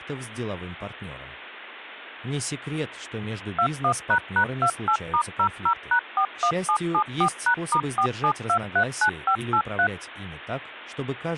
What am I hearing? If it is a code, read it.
DTMF, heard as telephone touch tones, dialled by machine, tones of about 80 ms. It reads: 21##28*00#41774#*47239583